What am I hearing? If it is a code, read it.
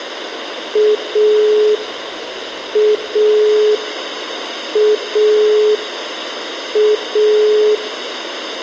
Telephone call progress tone (pulsed, as in Italy), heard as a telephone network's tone, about 420 Hz, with phone line noise and room echo. Dial tone.